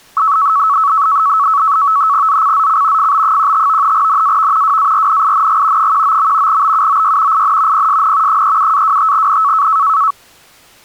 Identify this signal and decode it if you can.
NAVTEX (SITOR-B), 100 baud, 170 Hz shift, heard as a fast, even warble, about 1210 Hz centre. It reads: ZCZC FB15 NAV WARNING 19. BUOY IN PSN 37-25N